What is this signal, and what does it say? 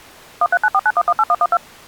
DTMF, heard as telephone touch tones, dialled by machine, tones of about 50 ms. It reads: 13949118112